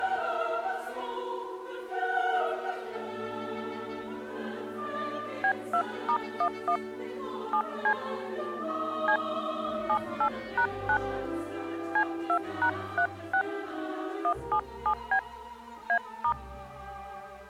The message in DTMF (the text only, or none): B2*11 7C C 78#9 C2#36 177B A*